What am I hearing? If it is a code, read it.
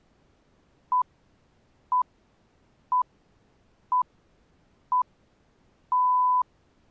Radio time signal (six pips, as the Greenwich Time Signal), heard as pips.